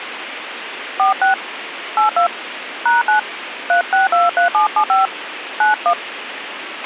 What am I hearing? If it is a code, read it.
DTMF, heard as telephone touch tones, dialled by hand, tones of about 120 ms, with radio hiss and a squelch burst at the end. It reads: 46 82 #9 3623775 91